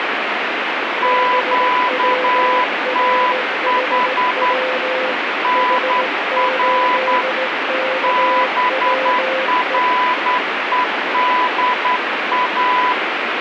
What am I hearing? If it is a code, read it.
Morse code, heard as two keyed tones, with radio static. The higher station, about 10 wpm, 1000 Hz: QTH NR BREDA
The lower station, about 17 wpm, 520 Hz: BWRHW H8KWE